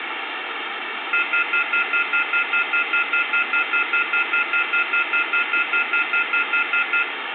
Telephone call progress tone (North American plan), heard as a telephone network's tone, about 1400, 2050, 2450, 2600 Hz, 0.1 s on and 0.1 s off, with phone line noise and room echo. Off-hook warning tone.